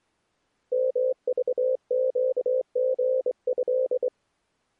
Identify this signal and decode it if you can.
Morse code (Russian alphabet), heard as a keyed tone, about 24 wpm, 520 Hz. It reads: МЖЩГЭ